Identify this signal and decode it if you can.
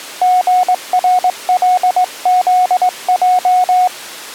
Morse code, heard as a keyed tone, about 20 wpm, 730 Hz. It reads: GRLZJ